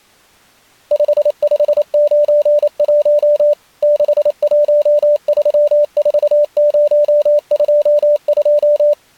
Morse code, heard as a keyed tone, machine-sent, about 28 wpm, 590 Hz. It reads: 5591 6134022